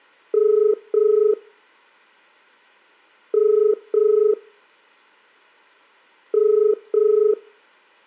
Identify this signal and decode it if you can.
Telephone call progress tone (as in the UK, Ireland, Australia and similar networks), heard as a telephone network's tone, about 430 Hz, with room echo. Ringback tone.